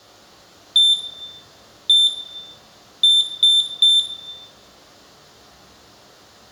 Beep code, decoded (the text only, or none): 1-1-3